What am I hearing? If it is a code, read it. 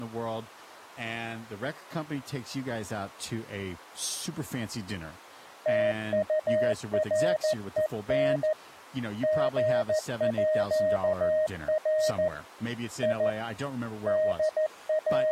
Morse code (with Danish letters), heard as a keyed tone, hand-sent with a paddle, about 14 wpm, 620 Hz, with speech in English. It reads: TUREN GÅR I …